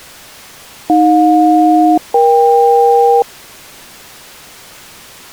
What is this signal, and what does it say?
Aircraft SELCAL, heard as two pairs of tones. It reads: AJ-EK